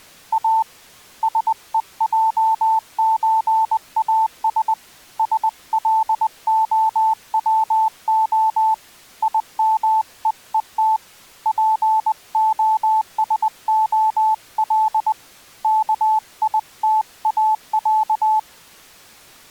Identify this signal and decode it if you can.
Morse code (Russian alphabet), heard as a keyed tone, hand-sent with a paddle, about 20 wpm, 880 Hz. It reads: А СЕЙЧАС СЛОВО ИМЕЕТ ПОСОЛ КИТАЯ